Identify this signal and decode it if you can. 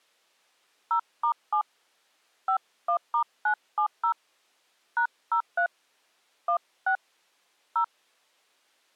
DTMF, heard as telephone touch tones, dialled by hand, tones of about 90 ms. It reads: 0*7 51*970 #03 16 0